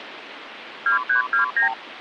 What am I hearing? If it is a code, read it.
Multi-frequency trunk signalling (R2, with the far end's replies), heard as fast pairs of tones, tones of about 120 ms, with phone line noise. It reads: 2329